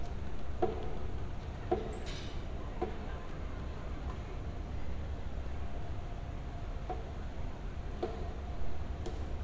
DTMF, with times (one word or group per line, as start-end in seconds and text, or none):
none